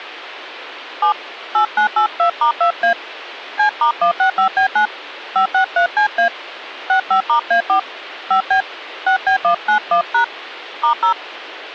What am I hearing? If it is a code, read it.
DTMF, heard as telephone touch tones, dialled by hand, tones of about 100 ms. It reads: 7 8982*2A C*165B9 563CA 65*A4 5B 6B191# *0